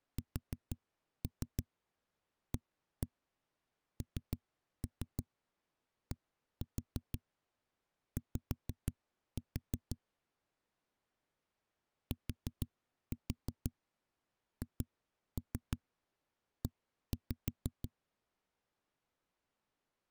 Tap code, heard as knocks on a wall, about 6 knocks a second. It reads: SANDY THE